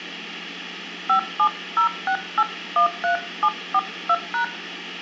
DTMF, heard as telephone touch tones, dialled by hand, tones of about 80 ms, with hum and room echo. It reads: 5706813742#